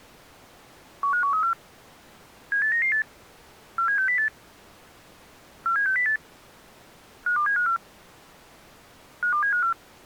Five-tone selective call (CCIR), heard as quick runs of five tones, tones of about 100 ms. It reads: 15134 78998 47608 47608 52754 52754